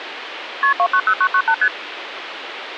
Multi-frequency trunk signalling (R1, as on North American trunks), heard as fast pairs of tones, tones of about 70 ms, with phone line noise. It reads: KP 290998 ST